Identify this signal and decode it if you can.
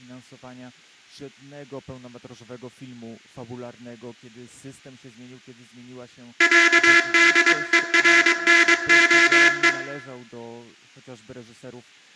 Morse code (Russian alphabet), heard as a buzzer, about 22 wpm, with room echo. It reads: ЯДЕРНОЕ